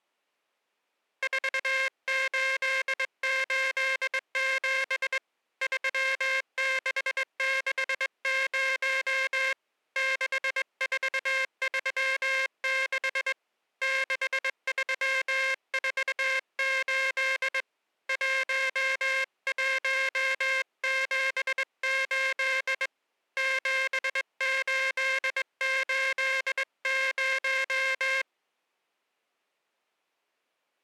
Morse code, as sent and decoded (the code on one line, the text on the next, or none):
....- ---.. ---.. --... / ...-- -.... -.... ----- / -.... ....- ...-- -.... / -.... ...-- ....- ---.. / .---- .---- --... ---.. / --... ---.. ---.. -----
4887 3660 6436 6348 1178 7880